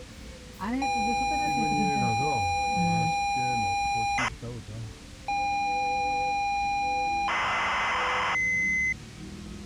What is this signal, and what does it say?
ZX Spectrum tape loading, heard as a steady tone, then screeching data, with the noise inside a car.